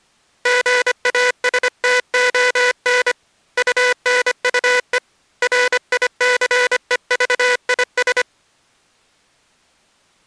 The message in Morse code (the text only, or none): GASTON UNUE RICEVIS